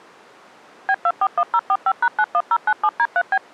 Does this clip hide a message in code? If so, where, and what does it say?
Yes: DTMF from 0.9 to 3.4 s, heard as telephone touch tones, dialled by machine, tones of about 60 ms. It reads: B241045#91097D3B